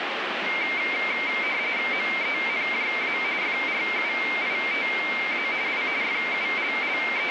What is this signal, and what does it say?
RTTY (45.45 baud, 170 Hz shift), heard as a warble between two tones, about 2200 Hz centre, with radio static. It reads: MENJA FRUITA I …